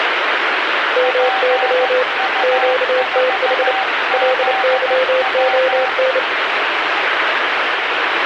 Morse code, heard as two keyed tones, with radio static. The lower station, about 29 wpm, 510 Hz: MY QTH LYON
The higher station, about 15 wpm, 770 Hz: PU4ZW